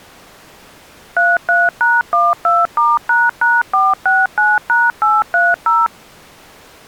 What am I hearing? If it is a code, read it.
DTMF, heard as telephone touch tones, dialled by machine, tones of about 200 ms. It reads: 33#12*##469#830